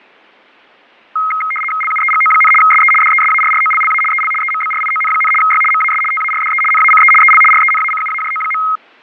RTTY (75 baud, 850 Hz shift), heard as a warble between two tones, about 1700 Hz centre, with fading. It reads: LUEGO, SE DESARROLLA EL EMBRION, Y MAS TARDE NACE EL RENACUAJO.